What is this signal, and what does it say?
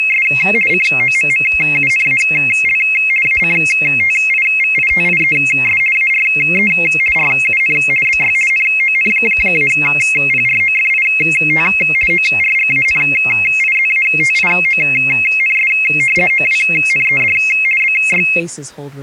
RTTY (50 baud, 450 Hz shift), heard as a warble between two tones, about 2350 Hz centre. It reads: … COMMUNAL ACTIVITIES ARE RUN BY NON-PROFIT ORGANIZATIONS OWNED BY